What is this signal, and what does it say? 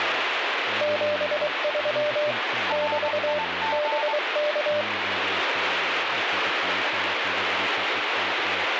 Morse code, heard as two keyed tones, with radio static and speech in Polish. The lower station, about 23 wpm, 600 Hz: 73 <BT> BK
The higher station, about 21 wpm, 890 Hz: RIG